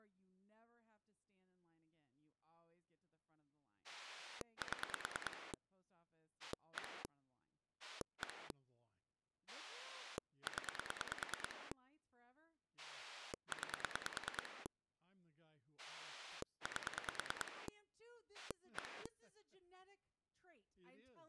Pulse dialling, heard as a rotary dial, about 9 pulses a second, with speech in English. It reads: 7 1 1 0 9 8 1